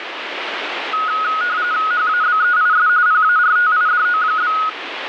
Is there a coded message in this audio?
Yes: RTTY (45.45 baud, 170 Hz shift) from 0.9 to 4.7 s, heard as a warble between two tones, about 1360 Hz centre, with radio static. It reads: HABEIS PARTIDO?